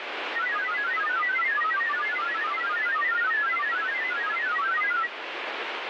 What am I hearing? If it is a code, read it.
Multi-tone FSK (Olivia or MFSK type), about 1000 Hz wide, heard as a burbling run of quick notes, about 31.25 baud, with radio static.